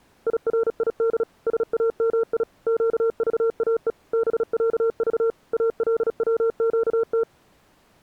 Morse code (Arabic alphabet), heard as a keyed tone, machine-sent, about 36 wpm, 460 Hz. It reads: يريد سامي قضاء بعض الوقت